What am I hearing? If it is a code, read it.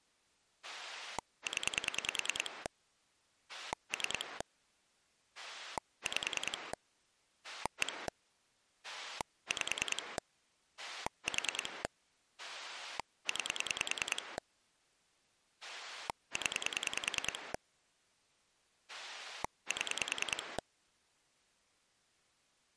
Pulse dialling, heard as a rotary dial, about 10 pulses a second. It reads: 0 3 5 1 5 4 9 0 7